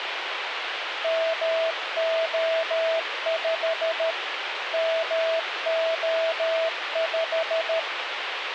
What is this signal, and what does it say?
Morse code, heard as a keyed tone, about 13 wpm, 650 Hz, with radio hiss. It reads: MO5 MO5